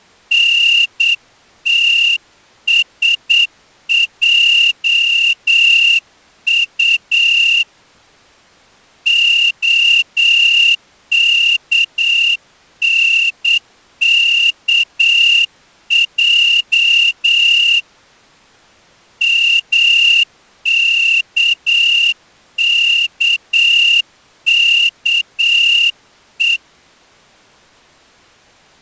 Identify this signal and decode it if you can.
Morse code (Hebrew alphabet), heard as a whistle, hand-sent with a straight key, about 8 wpm. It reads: נתשעט הכנכע מכככו